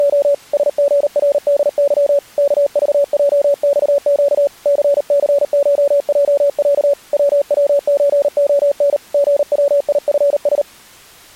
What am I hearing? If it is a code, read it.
Morse code (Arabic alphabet), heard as a keyed tone, hand-sent with a paddle, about 38 wpm, 570 Hz. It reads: … سغردظ كضجصق ثثشجع ووزخن غويفس